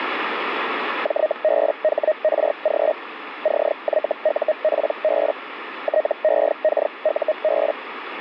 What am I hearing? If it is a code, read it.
Hellschreiber (Feld-Hell, 122.5 baud), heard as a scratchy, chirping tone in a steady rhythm, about 620 Hz, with radio static. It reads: JBHRG CYUPB TEKUB